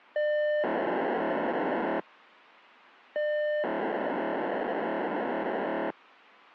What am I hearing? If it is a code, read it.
POCSAG pager data (1200 baud), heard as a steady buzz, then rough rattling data.